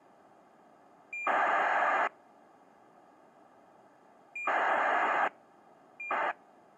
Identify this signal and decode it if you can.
ACARS aircraft data, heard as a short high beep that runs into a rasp, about 2400 baud.